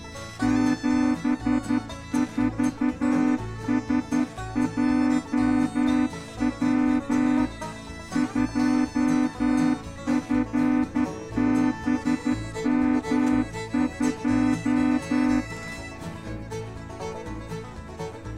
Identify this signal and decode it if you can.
Morse code, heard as a horn, hand-sent with a straight key, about 11 wpm. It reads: 74SJW 2FBM2